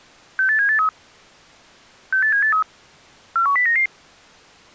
Five-tone selective call (CCIR), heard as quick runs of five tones, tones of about 100 ms. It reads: 68783 68783 41099